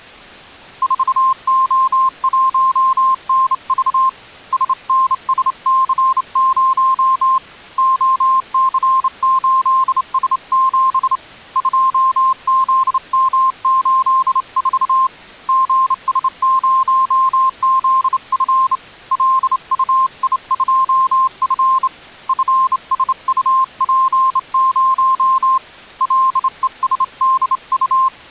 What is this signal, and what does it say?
Morse code, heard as a keyed tone, hand-sent with a straight key, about 28 wpm, 1050 Hz. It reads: 4O1NV SNSC0 OC8S7 2ZM84 GS0ZF LUI2F FSUP0 LESDU